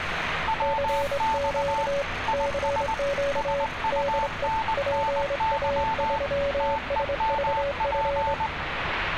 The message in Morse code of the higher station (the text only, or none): WX IS SUNNY TEMP